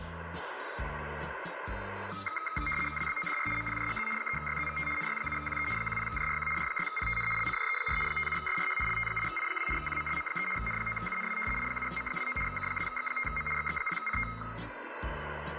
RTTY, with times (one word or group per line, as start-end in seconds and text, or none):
3.0-3.5 WBODR
3.6-4.1 MPJGZ
4.2-4.9 3YZVT
5.0-5.7 NY7QE
5.8-6.5 10JRQ
6.6-7.3 J6PTN
7.4-8.0 LCJE4
8.1-8.8 57SRH
8.9-9.7 LT8I2
9.8-10.5 QMLM3
10.6-11.4 N9UNW
11.6-12.4 I7M29
12.5-13.5 K2X5M
13.6-14.3 XX0CT